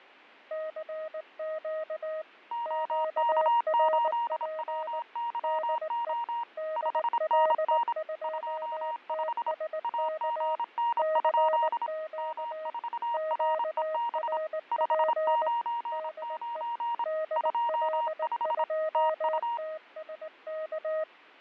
Morse code, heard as two keyed tones, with fading. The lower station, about 19 wpm, 630 Hz: CQ QRP DE DL2TSK CQ QRP DE DL2TSK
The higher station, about 26 wpm, 940 Hz: OK8WYO 5NN 25 AGN? M4REB 599 25 TU